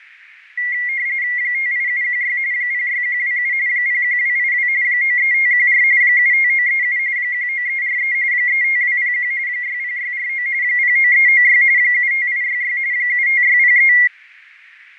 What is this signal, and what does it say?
RTTY (45.45 baud, 170 Hz shift), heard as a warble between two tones, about 2050 Hz centre, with radio static and fading. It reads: 58716 06127 01282 93514 75937 19343 35201 60649 09396 75866 75603